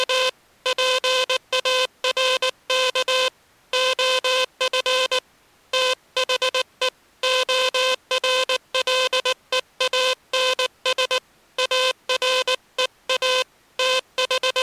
Morse code, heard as a buzzer, hand-sent with a paddle, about 19 wpm. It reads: … PARK OF THE ORLEANS AREA …